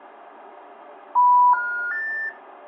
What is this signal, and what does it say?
Telephone call progress tone (North American plan), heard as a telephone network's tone, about 980, 1430, 1800 Hz, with room echo. Special information tone.